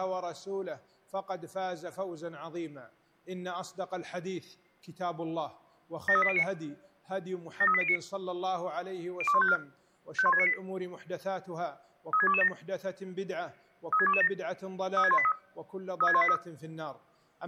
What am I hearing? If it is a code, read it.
Five-tone selective call (ZVEI), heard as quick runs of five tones, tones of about 70 ms. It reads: 73809 73809 02154 51698 36227 36227 36183 36183